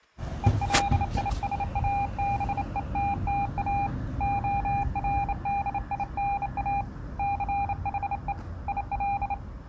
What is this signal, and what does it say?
Morse code, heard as a keyed tone, hand-sent with a bug key, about 28 wpm, 800 Hz, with the noise of a residential street. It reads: ELISABETTA ORDINA CHE IL